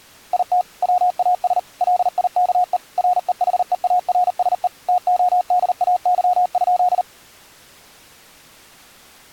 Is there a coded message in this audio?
Yes: Morse code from 0.3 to 7.1 s, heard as a keyed tone, machine-sent, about 39 wpm, 720 Hz. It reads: IT WAS LIKE REHEARSE TODAY?